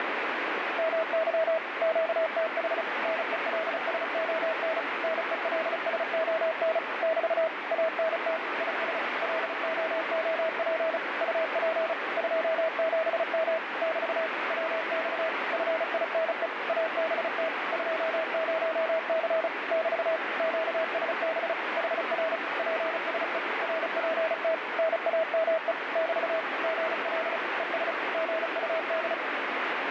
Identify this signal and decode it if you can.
Morse code, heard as a keyed tone, machine-sent, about 35 wpm, 640 Hz, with heavy radio static. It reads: MY QTH NELSON NELSON <BT> ANT IS LOOP UP 27M <BT> WX FINE ABT 20C <BT> QSB HR PSE RPT NAME <BT> GL ES GUD